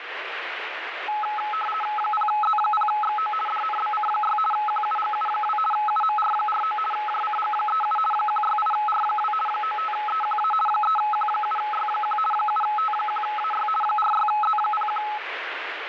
RTTY (50 baud, 450 Hz shift), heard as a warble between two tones, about 1070 Hz centre, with radio static. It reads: 0Z0XO DNBC6 QUGU2 UMR49 JCG37 168R2 95EQA 3Q7Y1 7T1AY 46Z01